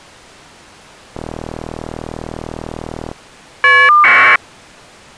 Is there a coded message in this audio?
Yes: caller ID data burst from 1.1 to 4.4 s, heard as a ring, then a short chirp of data, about 1200 baud.